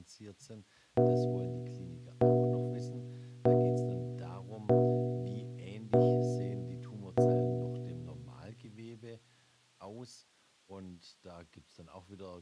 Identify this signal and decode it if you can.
Clock strike, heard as a bell, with speech in German. 6. Six o'clock.